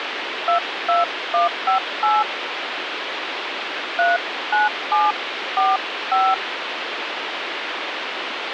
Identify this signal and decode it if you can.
DTMF, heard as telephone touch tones, dialled by hand, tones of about 190 ms, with phone line noise. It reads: 22158 39745